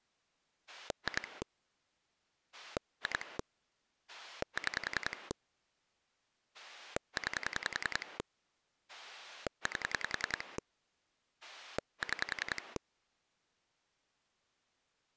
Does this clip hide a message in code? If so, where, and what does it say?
Yes: pulse dialling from 0.7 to 12.8 s, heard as a rotary dial, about 10 pulses a second. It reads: 2 2 6 9 8 6